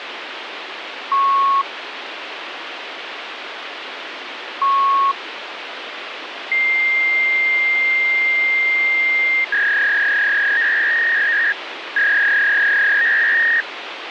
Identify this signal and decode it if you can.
Fax machine handshake, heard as beeps, a long tone and a warble, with phone line noise.